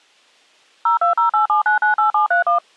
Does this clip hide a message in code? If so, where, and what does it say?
Yes: DTMF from 0.9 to 2.6 s, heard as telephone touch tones, dialled by machine, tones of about 120 ms. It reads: 02087998731